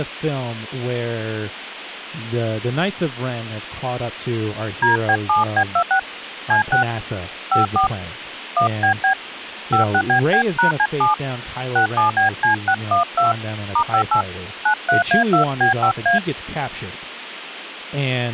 DTMF, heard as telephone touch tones, dialled by hand, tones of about 100 ms, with speech in English. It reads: DB7B26 C6 54 1BB 56BB#C7 67BC612 *58 93A2B5A